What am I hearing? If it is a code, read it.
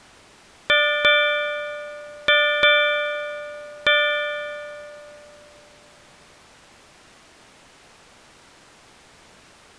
Ship's bell, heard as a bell. 5. Five half-hours of the watch have passed.